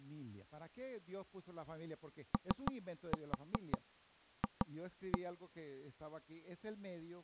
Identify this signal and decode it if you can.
Tap code, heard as knocks on wood, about 5 knocks a second, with speech in Spanish. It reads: OF